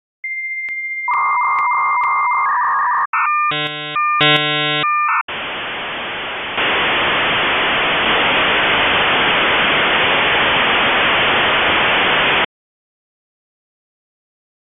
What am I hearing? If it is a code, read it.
Dial-up modem handshake (V.34 or later), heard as a whistle, warbles, then hiss.